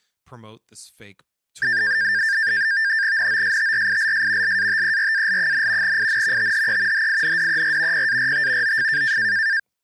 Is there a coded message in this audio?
Yes: NAVTEX (SITOR-B), 100 baud, 170 Hz shift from 1.6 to 9.6 s, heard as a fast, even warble, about 1700 Hz centre, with speech in English. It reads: NOSTRILS LATERAL, IN THE HINDER PART OF